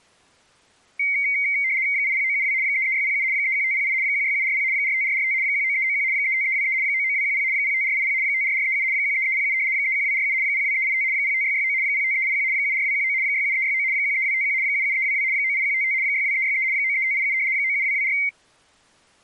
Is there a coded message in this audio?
Yes: RTTY (75 baud, 170 Hz shift) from 1.0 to 18.3 s, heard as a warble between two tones, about 2150 Hz centre. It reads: 80972 33607 31508 16740 45445 19391 35323 99210 05480 54437 13307 31247 02385 05669 05381 74219 67369 13251 77322 98155 62363 93587 97224